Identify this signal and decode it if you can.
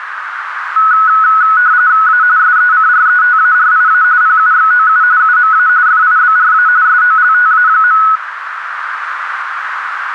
RTTY (45.45 baud, 170 Hz shift), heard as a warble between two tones, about 1380 Hz centre, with radio static and a narrow filter. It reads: A SECRETARIA PUXOU UMA FIBRA SOLTA.